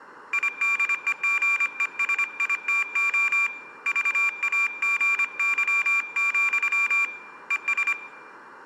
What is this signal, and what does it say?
Morse code, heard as a high beeper, hand-sent with a paddle, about 25 wpm, 2400 Hz, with room echo. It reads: IDEGESITO VAGY, ES